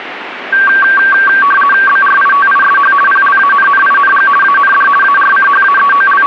RTTY (50 baud, 450 Hz shift), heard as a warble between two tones, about 1350 Hz centre, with radio static. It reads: BRITISH PLANNING AND …